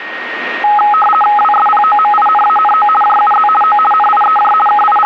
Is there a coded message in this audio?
Yes: RTTY (50 baud, 450 Hz shift) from 0.6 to 5.1 s, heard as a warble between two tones, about 1060 Hz centre, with radio static and a steady whistle near 1860 Hz. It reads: WSPOMINANO JUZ O NIEJ …